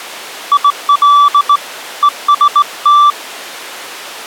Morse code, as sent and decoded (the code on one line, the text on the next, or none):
.. .-.. / . ... -
IL EST